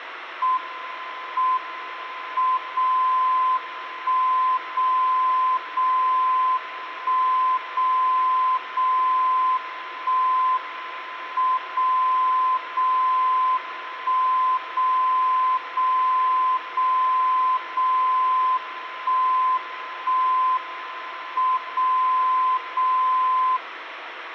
Radio time signal (WWVB), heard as a tone whose level steps once a second, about 1030 Hz, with radio static. The time is 23:29 UTC. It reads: M M 0 1 0 0 1 0 0 1 M 0 0 1 0 0 0 0 1 1 M 0 0